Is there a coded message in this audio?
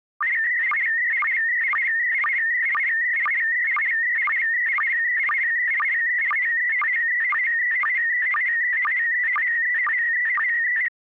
Yes: SSTV (slow-scan television), PD 120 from 0.2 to 10.9 s, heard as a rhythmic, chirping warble.